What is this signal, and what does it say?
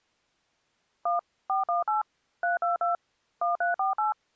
DTMF, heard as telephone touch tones, dialled by machine, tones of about 140 ms. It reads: 1 418 322 1348